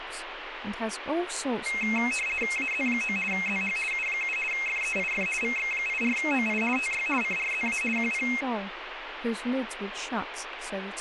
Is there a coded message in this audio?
Yes: RTTY (50 baud, 450 Hz shift) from 1.7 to 8.4 s, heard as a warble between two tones, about 2350 Hz centre, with radio static and speech in English. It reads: AZ9 ZH U7 FEIF VX84OI TY CRZA QP